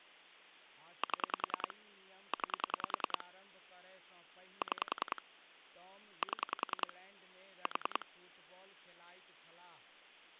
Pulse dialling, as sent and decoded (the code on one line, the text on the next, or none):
7 / 9 / 6 / 7 / 4
7 9 6 7 4